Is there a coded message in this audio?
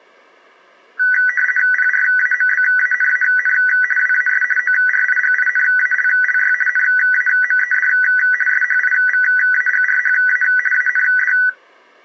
Yes: RTTY (50 baud, 450 Hz shift) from 1.0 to 11.5 s, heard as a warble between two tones, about 1700 Hz centre. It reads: PRAMBANAN WAS ORIGINALLY NAMED SHIVAGRHA AND